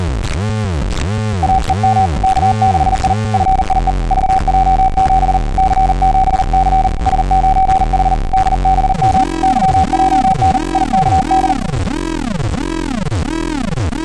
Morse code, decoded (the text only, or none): AEM K6I FIE VJ7 C7C S9H DBM YJN IKD